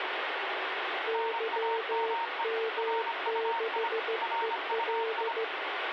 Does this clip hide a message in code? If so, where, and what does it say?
Yes: Morse code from 1.0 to 5.5 s, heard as two keyed tones, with radio static. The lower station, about 15 wpm, 450 Hz: YM6EL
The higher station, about 25 wpm, 920 Hz: NAME RUI RUI